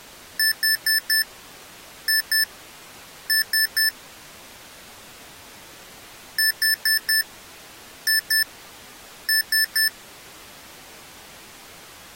Beep code, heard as beeps from a small speaker, played twice, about 1750 Hz. 4-2-3. In Phoenix BIOS tables: gate A20 failure.